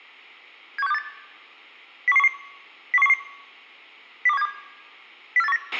Five-tone selective call (EEA), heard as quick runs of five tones, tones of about 40 ms, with a squelch burst at the end and room echo. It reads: 71628 01111 01111 02172 04819